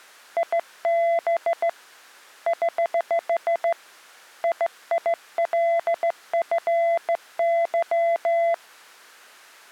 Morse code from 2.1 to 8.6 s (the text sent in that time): <HH> IILFY